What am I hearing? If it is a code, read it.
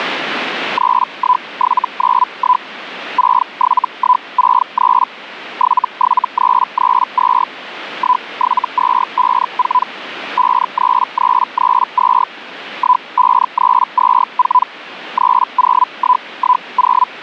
Hellschreiber (Feld-Hell, 122.5 baud), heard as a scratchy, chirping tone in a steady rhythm, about 1000 Hz, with radio static. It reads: 31791 67163 77332 17254 53332 15324 30110